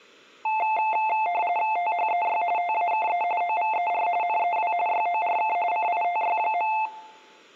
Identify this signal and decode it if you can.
RTTY (45.45 baud, 170 Hz shift), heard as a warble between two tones, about 790 Hz centre. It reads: THEY TAKE OVER NEW YORK CITY.